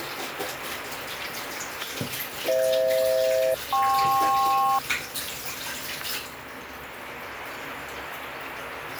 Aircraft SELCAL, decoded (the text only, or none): FH-KP